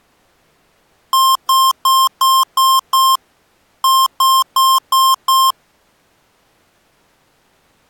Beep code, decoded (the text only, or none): 6-5